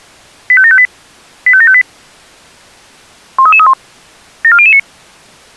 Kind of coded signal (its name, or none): five-tone selective call